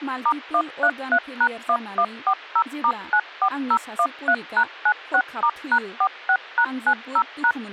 DTMF, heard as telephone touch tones, dialled by machine, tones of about 70 ms, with speech in Bodo. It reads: *133#1140*94013#96*#46#90#